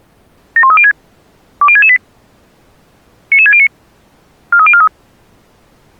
Five-tone selective call (ZVEI), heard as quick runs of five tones, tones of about 70 ms. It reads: 71306 20668 99609 43043